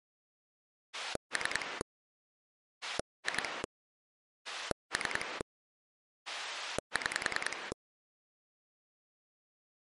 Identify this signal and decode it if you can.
Pulse dialling, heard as a rotary dial, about 10 pulses a second. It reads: 3 2 3 6